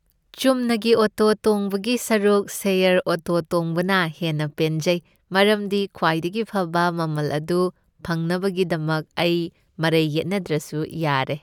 Speech in Manipuri. There is no code.